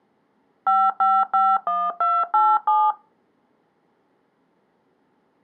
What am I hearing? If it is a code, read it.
DTMF, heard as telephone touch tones, dialled by machine, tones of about 230 ms. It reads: 5551287